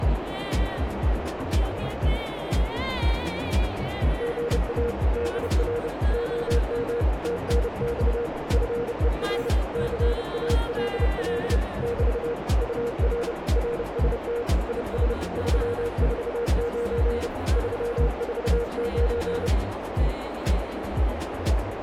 Morse code, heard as a keyed tone, hand-sent with a bug key, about 30 wpm, 470 Hz, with heavy radio static and a narrow filter. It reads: GA DR OM TNX FER CALL <BT> UR RST IS 349 349